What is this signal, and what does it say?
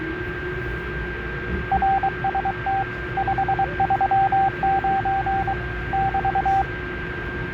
Morse code, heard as a keyed tone, hand-sent with a paddle, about 23 wpm, 780 Hz, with radio static, a steady whistle near 1590 Hz and the noise inside a subway train. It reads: RST 539 <BT>